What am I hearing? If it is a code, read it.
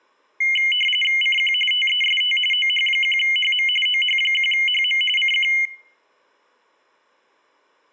RTTY (45.45 baud, 850 Hz shift), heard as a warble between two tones, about 2550 Hz centre. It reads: CQ TEST OH1HM OH1HM CQ